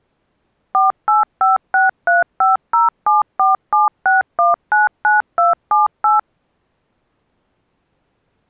DTMF, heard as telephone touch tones, dialled by machine, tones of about 150 ms. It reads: 48563507476199278